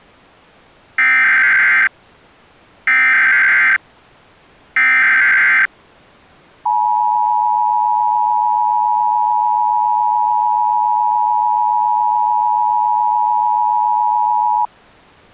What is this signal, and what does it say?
Emergency Alert System (SAME) tones (header bursts, then the 853 and 960 Hz attention tone), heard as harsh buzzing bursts, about 520.83 baud.